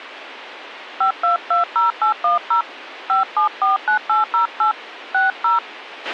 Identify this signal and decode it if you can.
DTMF, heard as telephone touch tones, dialled by hand, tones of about 130 ms, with a squelch burst at the end. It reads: 5220810 5749808 60